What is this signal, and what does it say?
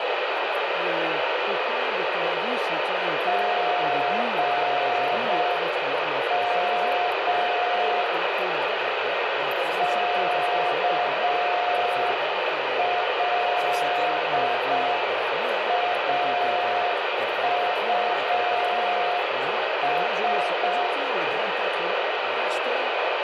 Morse code, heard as a keyed tone, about 6 wpm, 710 Hz, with heavy radio static. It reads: GM KLAUS